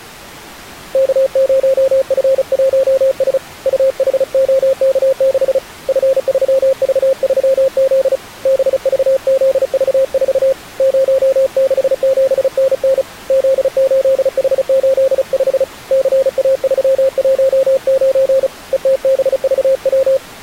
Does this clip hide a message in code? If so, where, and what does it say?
Yes: Morse code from 0.9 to 20.2 s, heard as a keyed tone, hand-sent with a paddle, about 35 wpm, 530 Hz. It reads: K0F1S UHOK6 F3V3Z BVZV4 067NN Z8H85 CA319 ETBVW